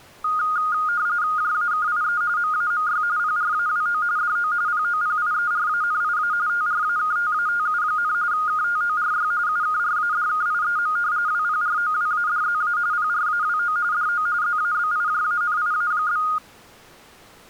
RTTY (45.45 baud, 170 Hz shift), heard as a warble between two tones, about 1330 Hz centre. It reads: JAKIE MAMY PRAWO DO POPIERANIA TRAKTATU, KTORY UKRADKIEM WPROWADZA PRAWO DO ZABIJANIA?